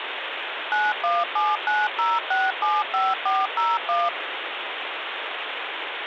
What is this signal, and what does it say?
DTMF, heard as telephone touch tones, dialled by machine, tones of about 200 ms, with phone line noise. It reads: 91790675401